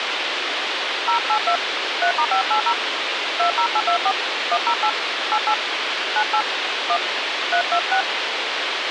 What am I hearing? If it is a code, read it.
DTMF, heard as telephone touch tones, dialled by hand, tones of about 80 ms, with radio hiss and a squelch burst at the end. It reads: 082 3*580 20824 108 88 98 1 326